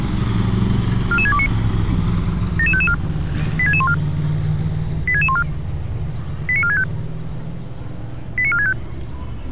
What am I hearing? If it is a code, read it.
Five-tone selective call (ZVEI), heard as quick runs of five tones, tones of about 70 ms, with street noise. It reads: 44629 77554 86614 86614 89465 89465